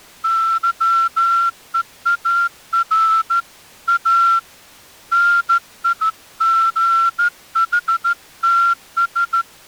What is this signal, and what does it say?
Morse code, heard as a whistle, hand-sent with a straight key, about 14 wpm. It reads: YEAR A NIGHTS